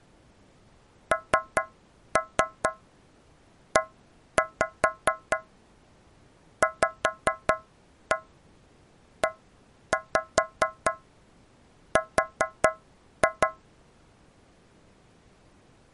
Tap code, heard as taps on a metal pipe, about 4 knocks a second. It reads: NEVER